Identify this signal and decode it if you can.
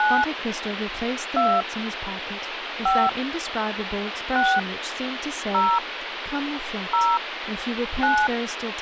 DTMF, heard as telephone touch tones, dialled by hand, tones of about 240 ms, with phone line noise and speech in English. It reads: 9 2 5 6 0 0 9